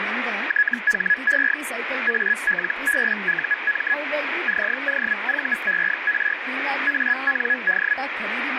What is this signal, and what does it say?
Hellschreiber (Feld-Hell, 122.5 baud), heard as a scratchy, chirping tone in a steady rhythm, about 1700 Hz, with radio static and speech in Kannada. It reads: THE ALBUM COVER AND